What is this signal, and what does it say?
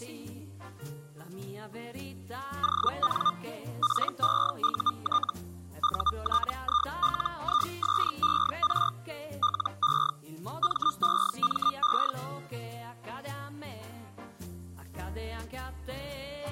Hellschreiber (Feld-Hell, 122.5 baud), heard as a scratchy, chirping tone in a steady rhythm, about 1210 Hz. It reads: ON PEUT UTILISER LE MEME